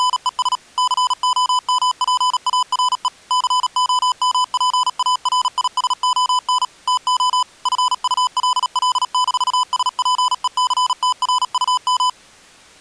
Morse code, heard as electronic beeps, machine-sent, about 37 wpm, 1000 Hz. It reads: … COMPARE COMPARISON TO FULL-SPECTRUM